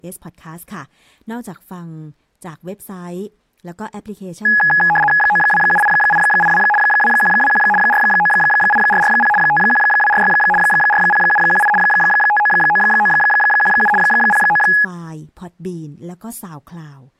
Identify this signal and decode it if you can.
RTTY (75 baud, 850 Hz shift), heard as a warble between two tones, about 1260 Hz centre, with speech in Thai. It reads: 9278882 2121 498440 51246 40718 599917 09